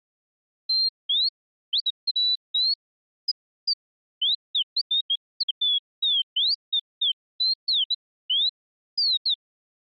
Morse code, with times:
none

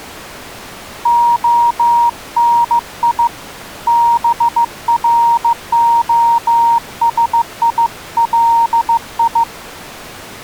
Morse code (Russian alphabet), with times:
1.1-3.3 ОНИ
3.9-9.4 БРОСИЛИ

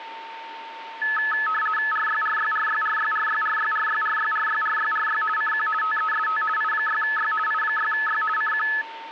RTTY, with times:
1.9-5.2 RYRYRYRYRYRYRYRYRYRYRY
5.4-5.7 CQ
5.8-6.4 TEST
6.6-7.3 I6Y
7.5-8.2 I6Y
8.4-8.7 CQ

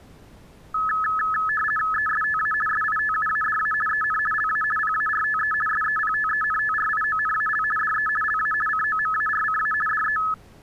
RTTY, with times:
1.9-2.5 ESTA
2.7-3.7 SITUADA
3.9-4.2 EN
4.3-4.6 LA
4.8-5.5 PARTE
5.7-7.6 SEPTENTRIONAL
7.8-8.1 DE
8.2-8.5 LA
8.7-9.7 COMARCA
9.9-10.2 DE

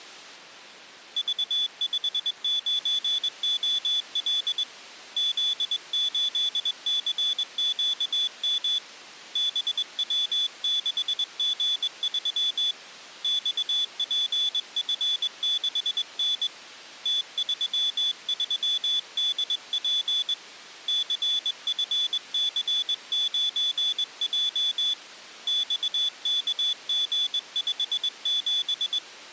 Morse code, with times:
1.2-4.6 V59OL
5.2-8.8 Z8CQM
9.4-12.7 BW6G3
13.2-16.5 XPF6N
17.1-20.3 T33DP
20.9-24.9 CFC9J
25.5-29.0 XKG57

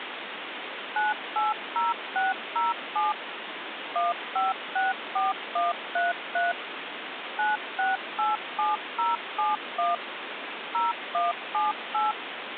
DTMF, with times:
1.0-3.1 980607
4.0-6.5 1564133
7.4-10.0 9687071
10.7-12.1 0178

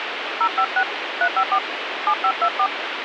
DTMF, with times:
0.4-0.8 056
1.2-1.6 354
2.1-2.7 7524

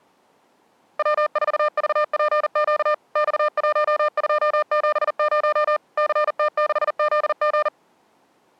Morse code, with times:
1.0-2.9 W4VPQ
3.2-5.8 X1270
6.0-7.7 CT6ZG

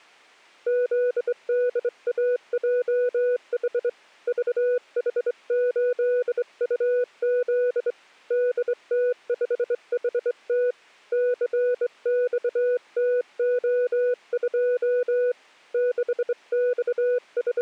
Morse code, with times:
0.7-3.9 ZDAJH
4.3-7.9 VH8UZ
8.3-10.7 DT5HT
11.1-15.3 CXTO2
15.7-17.6 …

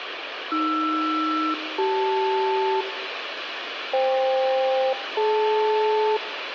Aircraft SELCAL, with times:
0.5-2.8 AR-CL
3.9-6.2 FK-DL

